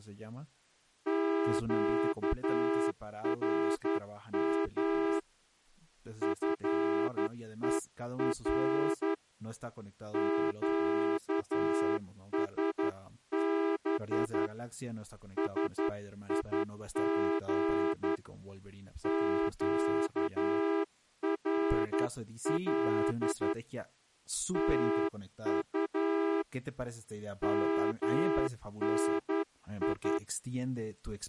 Morse code, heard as a horn, hand-sent with a straight key, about 11 wpm, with speech in Spanish. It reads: QRM FER QSB SIG QRL TU MNI